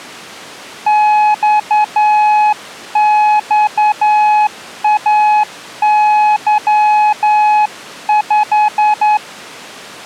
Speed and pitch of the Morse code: 10 wpm, 850 Hz

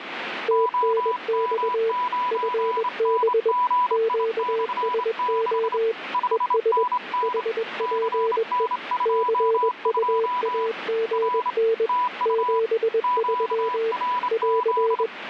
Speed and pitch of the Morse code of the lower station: 21 wpm, 450 Hz

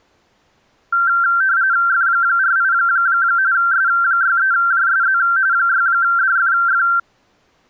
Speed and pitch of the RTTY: 45.45 baud, 170 Hz shift, 1470 Hz centre

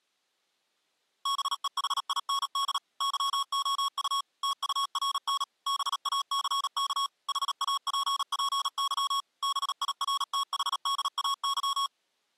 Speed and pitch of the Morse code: 37 wpm, 1110 Hz

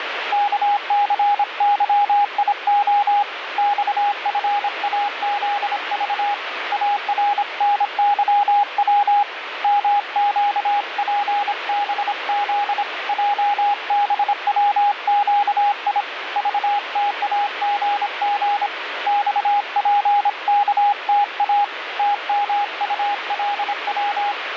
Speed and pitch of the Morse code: 26 wpm, 820 Hz

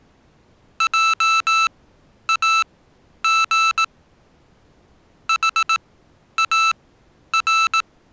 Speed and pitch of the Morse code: 18 wpm, spaced as for 10 wpm, 1320 Hz

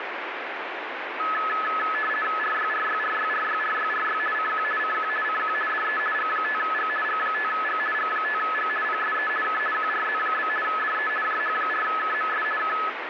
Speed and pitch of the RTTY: 50 baud, 450 Hz shift, 1500 Hz centre

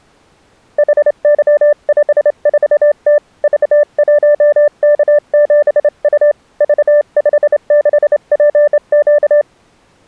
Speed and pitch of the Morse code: 28 wpm, 590 Hz

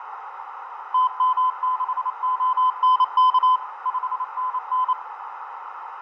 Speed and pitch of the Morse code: 28 wpm, 1020 Hz

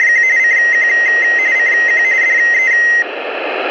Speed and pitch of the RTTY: 45.45 baud, 170 Hz shift, 2000 Hz centre

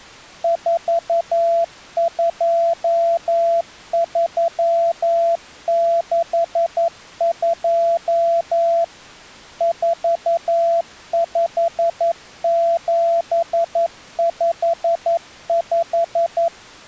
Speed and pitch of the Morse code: 11 wpm, 680 Hz

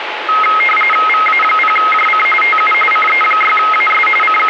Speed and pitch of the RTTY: 45.45 baud, 850 Hz shift, 1700 Hz centre

